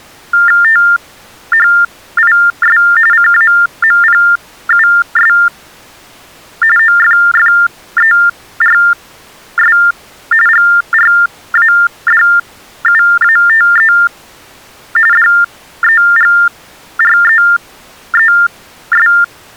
TTY/TDD text telephone tones (45.45 baud Baudot), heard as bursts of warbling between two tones, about 400 Hz shift, 1600 Hz centre. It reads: THIS CAMPUS OFFERS GRADUATE DEGREES